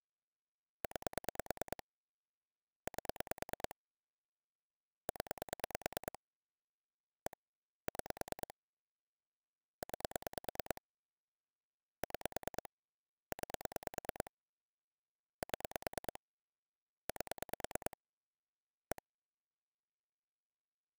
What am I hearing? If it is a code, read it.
Pulse dialling, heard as clicks on a phone line, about 9 pulses a second. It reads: 9 8 0 1 6 9 6 9 7 8 1